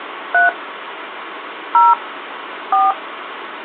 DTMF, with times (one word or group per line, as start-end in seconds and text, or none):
0.3-0.5 3
1.7-1.9 0
2.7-2.9 4